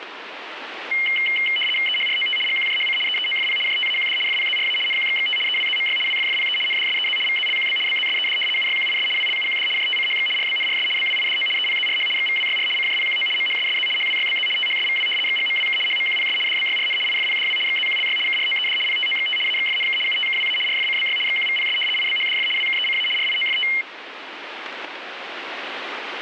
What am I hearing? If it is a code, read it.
RTTY (75 baud, 850 Hz shift), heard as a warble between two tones, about 2550 Hz centre, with radio static. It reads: EHROT GQJHC EEOFP JTAQD FPZRA NQXXT EWZMY WFFPE NDSEZ VZLQB BZSED UYQIS WLUQD JTCHX RBNRS BWIDO EPZRH XVWYR CJPQO MHSSZ HWYBZ THSVW XGMWK HMQPS DBYRN IFPDW XZQLY KROED PTOXT AXFNK UTKWA RFCBY XQVPS IBHDF WKECA RIOFT